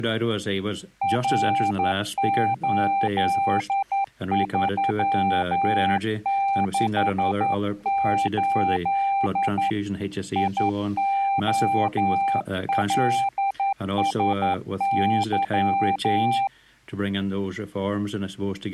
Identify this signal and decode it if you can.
Morse code, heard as a keyed tone, hand-sent with a straight key, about 11 wpm, 790 Hz. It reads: R8368 IOLSY